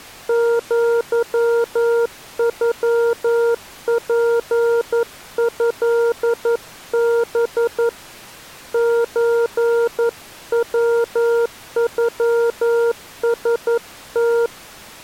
Morse code (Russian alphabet), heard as a keyed tone, hand-sent with a paddle, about 11 wpm, 470 Hz. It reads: ЪЮПЭБ ЧВЮСТ